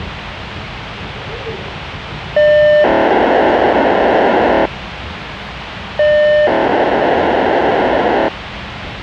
POCSAG pager data (1200 baud), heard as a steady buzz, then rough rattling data, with radio hiss and the noise inside a subway train.